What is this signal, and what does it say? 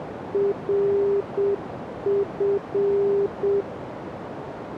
Morse code, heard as a keyed tone, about 7 wpm, 400 Hz, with radio static and a narrow filter. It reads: RF